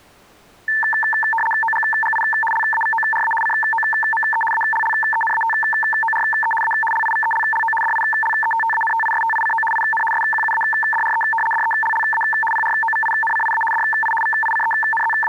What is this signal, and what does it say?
RTTY (75 baud, 850 Hz shift), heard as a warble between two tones, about 1330 Hz centre. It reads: OGGI LAVORA COME ALLENATORE A LIVELLO DILETTANTISTICO IN SQUADRE DELLA PROVINCIA DI …